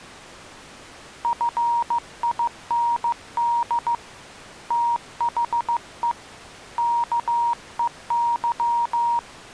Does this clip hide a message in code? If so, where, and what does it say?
Yes: Morse code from 1.2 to 9.3 s, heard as a keyed tone, hand-sent with a paddle, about 15 wpm, 940 Hz. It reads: FIND THE KEY